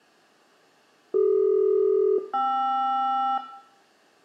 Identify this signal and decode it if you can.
Aircraft SELCAL, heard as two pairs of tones, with room echo. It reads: CD-KR